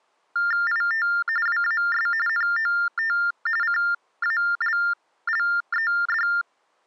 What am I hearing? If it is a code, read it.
TTY/TDD text telephone tones (45.45 baud Baudot), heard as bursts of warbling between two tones, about 400 Hz shift, 1600 Hz centre. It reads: IT WAS NOT CALLED